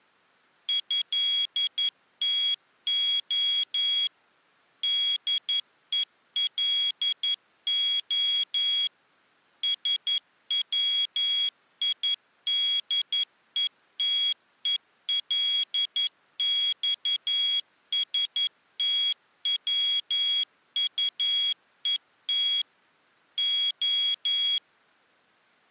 Morse code (Russian alphabet), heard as a high beeper, machine-sent, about 11 wpm, 3300 Hz. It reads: ЭТО ДЕЛО СВИДЕТЕЛЬСТВУЕТ О